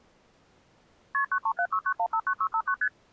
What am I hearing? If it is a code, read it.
Multi-frequency trunk signalling (R1, as on North American trunks), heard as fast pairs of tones, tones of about 70 ms. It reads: KP 93769159659 ST